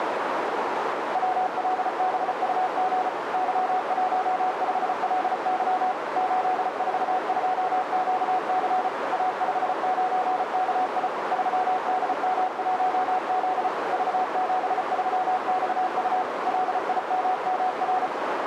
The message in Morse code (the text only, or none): WLBUG Y15LY 842QC A59KI 3DM1Z V73XU LIMMR